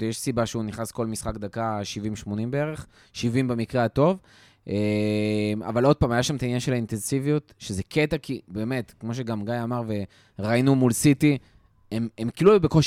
Speech in Hebrew. There is no code.